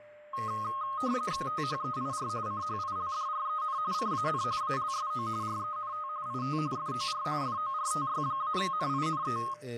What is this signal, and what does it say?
RTTY (45.45 baud, 170 Hz shift), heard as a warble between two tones, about 1160 Hz centre, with a steady whistle near 600 Hz and speech in Portuguese. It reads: THEIR CHILDREN CAN ALSO RENT IT FOR FORTY-NINE